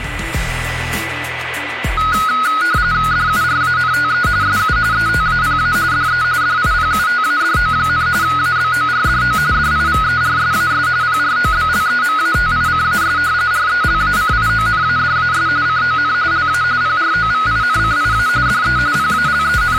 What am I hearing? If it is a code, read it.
RTTY (45.45 baud, 170 Hz shift), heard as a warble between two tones, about 1360 Hz centre, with radio static and a steady whistle near 1990 Hz. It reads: DURANTE SU ETAPA DE DIPUTADO, ABORDO DIVERSAS PROBLEMATICAS RELACIONADAS CON LA PROVINCIA DE …